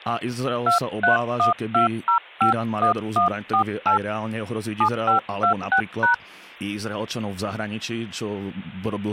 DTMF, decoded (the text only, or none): 2312051148 7526#